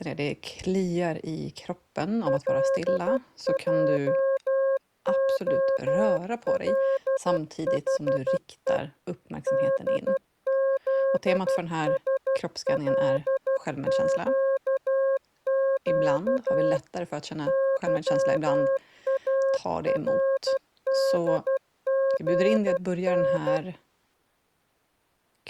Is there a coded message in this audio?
Yes: Morse code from 2.2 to 23.6 s, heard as a keyed tone, machine-sent, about 12 wpm, 540 Hz. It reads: LJOLHE DZSLQQ YARDGN